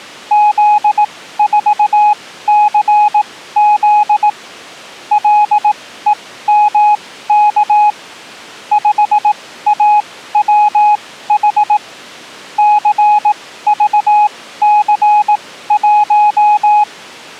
Morse code, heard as a keyed tone, machine-sent, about 18 wpm, spaced as for 14 wpm, 840 Hz. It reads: Z4CZ LEMK 5AWH CVC1